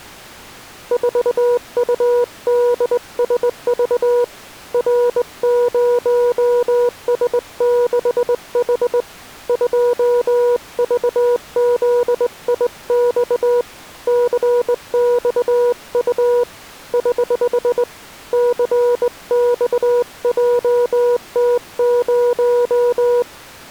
Morse code, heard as a keyed tone, hand-sent with a straight key, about 20 wpm, 480 Hz. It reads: 4UDSV R0S6H 2VZIX CXU <HH> CXJT0